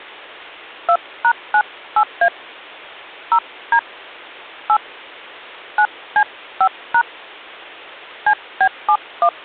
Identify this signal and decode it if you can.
DTMF, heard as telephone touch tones, dialled by hand, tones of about 70 ms. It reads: 2#98A 0D 8 9C5# CB71